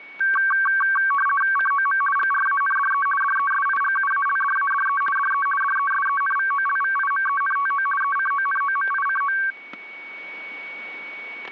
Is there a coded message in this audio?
Yes: RTTY (50 baud, 450 Hz shift) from 0.2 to 9.5 s, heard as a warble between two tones, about 1350 Hz centre, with static crashes and a steady whistle near 2240 Hz. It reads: COM GRANDE DESIGUALDADE DE DESENVOLVIMENTO ECONOMICO